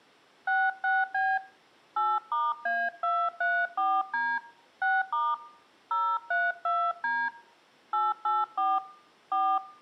DTMF, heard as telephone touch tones, dialled by hand, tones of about 230 ms. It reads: 66B 8*A234D 6* 032D 884 4